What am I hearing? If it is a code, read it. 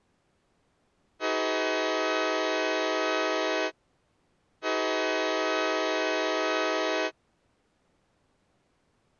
Train horn signal, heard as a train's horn. 2 long. On North American railways: brakes released, proceed.